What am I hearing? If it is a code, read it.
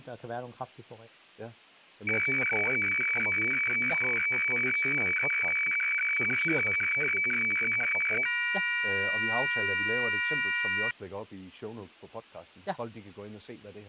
Weather fax (radiofax), 120 lines a minute, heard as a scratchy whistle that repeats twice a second, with speech in Danish.